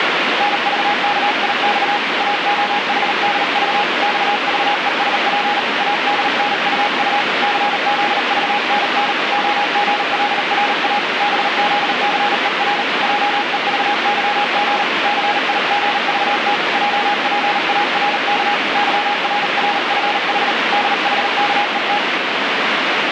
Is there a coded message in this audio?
Yes: Morse code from 0.3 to 22.0 s, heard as a keyed tone, hand-sent with a paddle, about 38 wpm, 830 Hz, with heavy radio static. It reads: NVKIX AOHDV XVESP ADNUU CZVNN OGLRA BZCER JEVYG CIGVT JPARK YRRFH DHKET